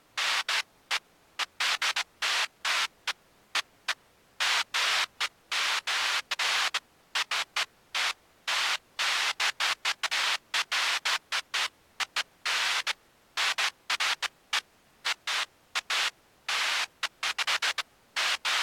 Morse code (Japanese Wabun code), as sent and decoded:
none

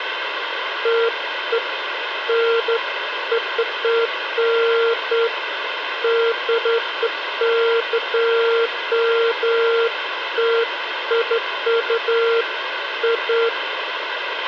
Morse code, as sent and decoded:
none

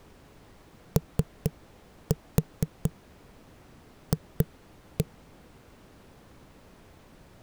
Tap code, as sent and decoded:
3-4 2-1
OF

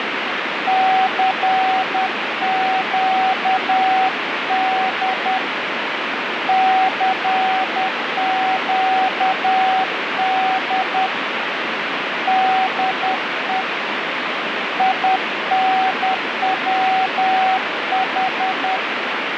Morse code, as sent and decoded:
-.-. --.- -.. / -.-. --.- -.. / -.. . / .. -. .-- ....
CQD CQD DE INWH

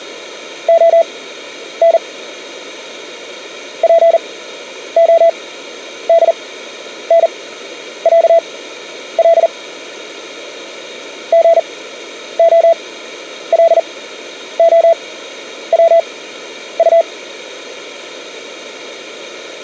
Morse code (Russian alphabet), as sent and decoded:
--- -. / .--. --- -.. -. .-.- .-.. / --. --- .-.. --- .-- ..-
ОН ПОДНЯЛ ГОЛОВУ

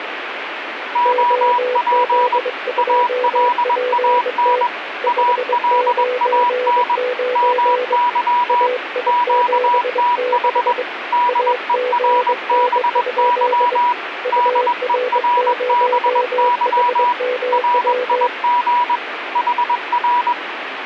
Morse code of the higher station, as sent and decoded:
--- .--. / .- .-.. .- -. / .- .-.. .- -. / -- -.-- / --.- - .... / -.. . .-. -... -.-- / -.. . .-. -... -.-- / .-. .. --. / .... .-.
OP ALAN ALAN MY QTH DERBY DERBY RIG HR

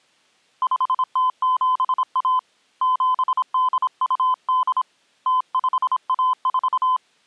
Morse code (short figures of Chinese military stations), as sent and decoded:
..... - --... .- / --... -.. ..- -.. / - ..... .- ....-
5071 7828 0514

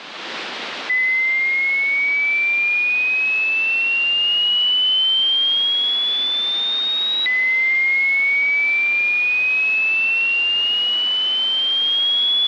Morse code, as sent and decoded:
none

